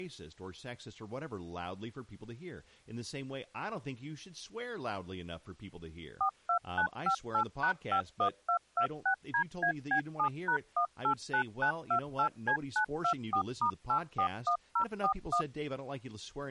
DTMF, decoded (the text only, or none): 42958#51226DAB7#189928C924*841041